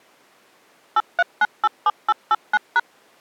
DTMF, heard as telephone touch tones, dialled by machine, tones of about 40 ms. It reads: 83987889#